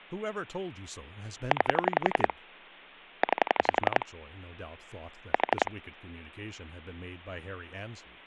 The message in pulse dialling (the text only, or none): 9 9 4